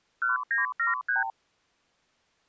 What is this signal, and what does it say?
Multi-frequency trunk signalling (R2, with the far end's replies), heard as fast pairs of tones, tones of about 140 ms. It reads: 1973